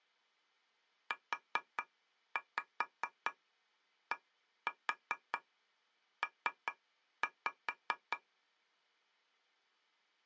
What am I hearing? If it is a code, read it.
Tap code, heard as taps on a table, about 4 knocks a second. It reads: UDP